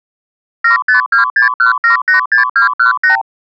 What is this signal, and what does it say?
Multi-frequency trunk signalling (R2, with the far end's replies), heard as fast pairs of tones, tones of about 120 ms. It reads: 75261786218